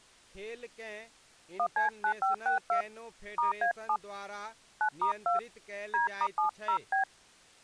DTMF, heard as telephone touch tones, dialled by hand, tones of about 100 ms, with speech in Maithili. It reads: 1C9562 *A7 9*2 D*70B